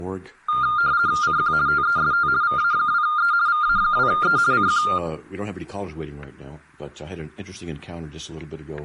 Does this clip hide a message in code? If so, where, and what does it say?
Yes: RTTY (50 baud, 170 Hz shift) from 0.5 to 5.0 s, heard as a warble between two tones, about 1310 Hz centre, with static crashes. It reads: CQ TEST VA2E VA2E CQ